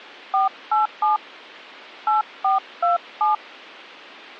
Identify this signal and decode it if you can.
DTMF, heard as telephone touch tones, dialled by hand, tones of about 140 ms. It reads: 487 8427